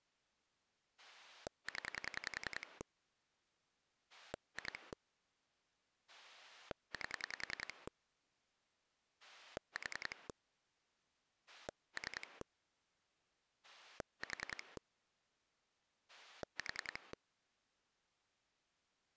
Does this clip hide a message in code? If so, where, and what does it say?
Yes: pulse dialling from 1.0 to 17.1 s, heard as a rotary dial, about 10 pulses a second. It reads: 0 2 8 4 3 4 4